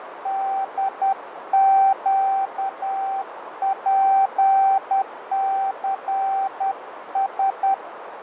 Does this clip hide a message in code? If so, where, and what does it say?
Yes: Morse code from 0.2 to 7.8 s, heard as a keyed tone, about 10 wpm, 780 Hz, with radio static, fading and a narrow filter. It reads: DQPCS